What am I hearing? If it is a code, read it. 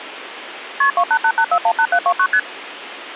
Multi-frequency trunk signalling (R1, as on North American trunks), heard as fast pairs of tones, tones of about 70 ms, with phone line noise. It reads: KP 2888418729 ST